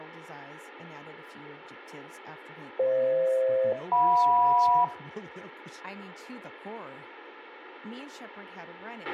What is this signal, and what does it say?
Aircraft SELCAL, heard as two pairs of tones, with a squelch burst at the end, room echo and speech in English. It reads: FH-JM